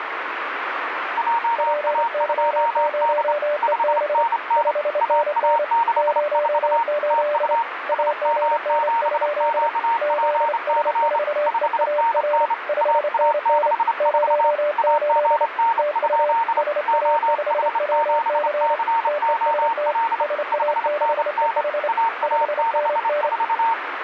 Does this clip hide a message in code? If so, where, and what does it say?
Yes: Morse code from 1.1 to 23.8 s, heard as two keyed tones, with radio static. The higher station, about 28 wpm, 920 Hz: JA2D 5NN AA64 TU SM7QPC 5NN AA64 AGN? OH7COL 5NN AA64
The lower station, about 28 wpm, 590 Hz: PY0EB 5NN 08 AGN? ZS4EAR 5NN 08 TU SA5WC TEST SA6EH 5NN